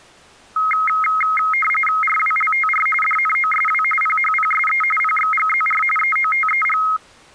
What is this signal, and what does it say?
RTTY (45.45 baud, 850 Hz shift), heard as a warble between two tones, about 1700 Hz centre. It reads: RWLTR DNOSW PHPSE PXGZR EOTEG